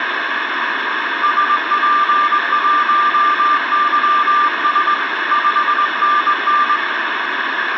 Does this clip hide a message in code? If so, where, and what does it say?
Yes: Morse code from 1.2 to 6.8 s, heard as a keyed tone, hand-sent with a straight key, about 21 wpm, 1190 Hz, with radio static and room echo. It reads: SP1YS 5NN